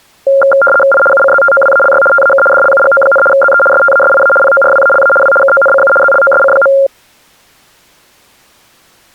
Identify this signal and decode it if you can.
RTTY (75 baud, 850 Hz shift), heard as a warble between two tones, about 970 Hz centre. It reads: I UCZTOWALY TAK DLUGO, ZE STASIA PORWALA W KONCU ZLOSC.